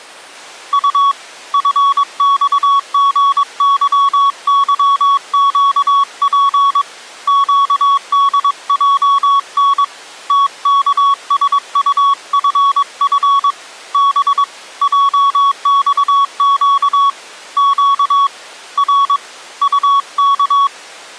Morse code, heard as a keyed tone, hand-sent with a paddle, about 22 wpm, 1120 Hz. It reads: U FXGYYQP QDJN TKSUFF B JXQ Q R UK